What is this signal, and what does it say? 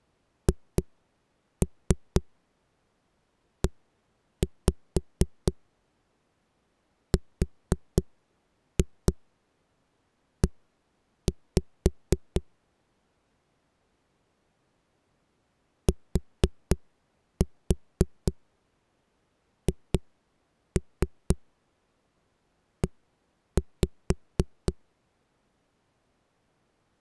Tap code, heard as knocks on a wall, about 4 knocks a second. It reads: HERE THE